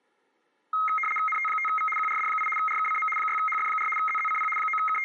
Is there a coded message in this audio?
Yes: RTTY (75 baud, 850 Hz shift) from 0.7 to 5.0 s, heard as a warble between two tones, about 1700 Hz centre, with room echo. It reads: NT5V QRD8 RKCM 6HF4 ZZCP …